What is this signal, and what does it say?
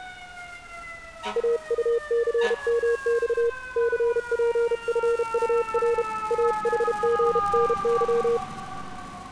Morse code, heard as a keyed tone, hand-sent with a paddle, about 32 wpm, 470 Hz, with street noise. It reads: AUCMX CPFUR AHGNY